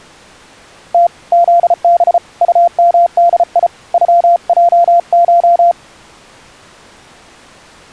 Morse code (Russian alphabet), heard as a keyed tone, hand-sent with a paddle, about 34 wpm, 690 Hz. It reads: Т ЗБ УМДИ ЮЙШ